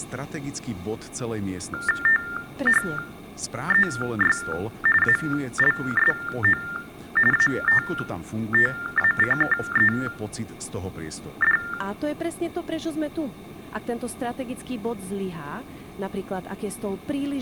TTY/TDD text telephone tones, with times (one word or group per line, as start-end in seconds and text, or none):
2.1-4.4 THEY
5.0-6.6 ALSO
7.3-11.6 ATTACKED